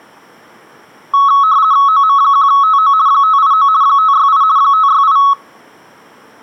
RTTY (50 baud, 170 Hz shift), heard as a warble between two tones, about 1200 Hz centre. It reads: OM1TO 589 568 568